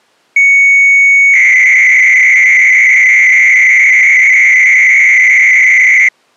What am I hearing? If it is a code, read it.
300-baud modem data (Bell 103 tones), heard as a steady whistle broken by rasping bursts, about 300 baud, 200 Hz shift.